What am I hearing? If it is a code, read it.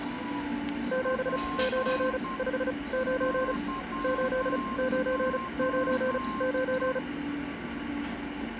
Morse code, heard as a keyed tone, machine-sent, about 35 wpm, spaced as for 24 wpm, 520 Hz, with a weaker station near 1060 Hz and the noise of a cafe. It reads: 7959 8999